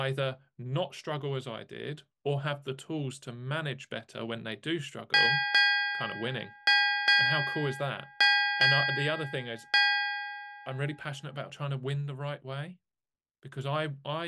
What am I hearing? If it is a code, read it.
Ship's bell, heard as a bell, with speech in English. 7. Seven half-hours of the watch have passed.